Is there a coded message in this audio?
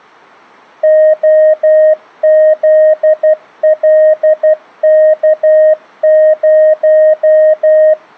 Yes: Morse code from 0.8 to 8.0 s, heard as a keyed tone, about 12 wpm, 620 Hz. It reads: OZLK0